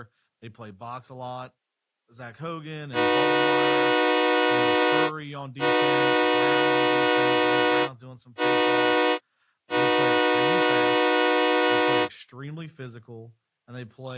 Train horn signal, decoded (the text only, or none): 2 long, 1 short, 1 long